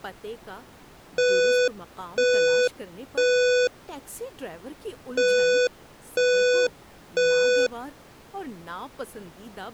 Alarm pattern, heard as an alarm's beeps, played twice, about 500 Hz, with speech in Urdu. Temporal three. Smoke or fire, evacuate.